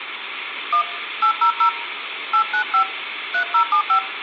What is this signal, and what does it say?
DTMF, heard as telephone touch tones, dialled by hand, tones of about 90 ms, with phone line noise. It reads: 1 800 895 3075